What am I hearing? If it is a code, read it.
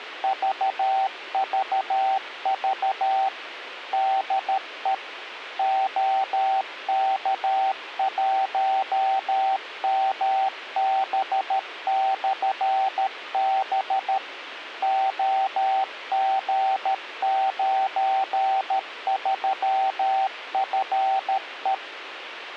Morse code, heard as a keyed tone, machine-sent, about 13 wpm, 770 Hz, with radio hiss. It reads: VVV DE OK1MB/B OG93FE